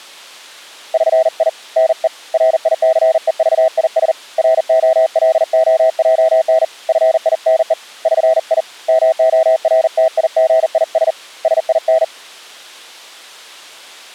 Morse code (with Esperanto letters), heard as a keyed tone, hand-sent with a paddle, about 40 wpm, 650 Hz. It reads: ŜI NE RICEVIS ROLOJN FINE ŜI MORTIGIS SIN